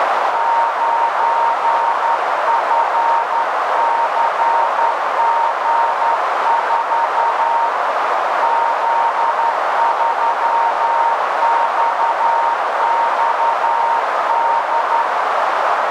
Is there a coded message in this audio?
Yes: Morse code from 0.3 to 15.1 s, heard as a keyed tone, hand-sent with a straight key, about 11 wpm, 920 Hz, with heavy radio static and a narrow filter. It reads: 9FCG4 Z3XXD